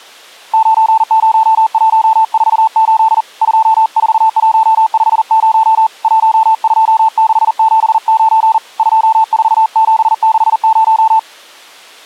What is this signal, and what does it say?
Morse code, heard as a keyed tone, hand-sent with a paddle, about 40 wpm, 890 Hz. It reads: 90148 24150 12679 24760